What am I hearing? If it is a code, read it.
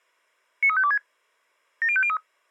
Five-tone selective call (ZVEI), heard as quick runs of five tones, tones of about 70 ms. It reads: 93526 70503